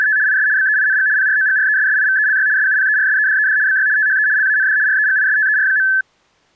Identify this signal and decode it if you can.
RTTY (75 baud, 170 Hz shift), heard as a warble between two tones, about 1650 Hz centre. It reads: … IS BEING PROGRESSIVELY SUPERSEDED BY THE LAND REGISTER.